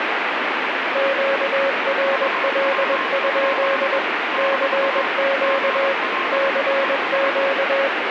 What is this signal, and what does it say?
Morse code, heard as two keyed tones, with heavy radio static. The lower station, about 21 wpm, 550 Hz: QRL? CQ CQ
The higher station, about 24 wpm, 1060 Hz: HW? - GL ES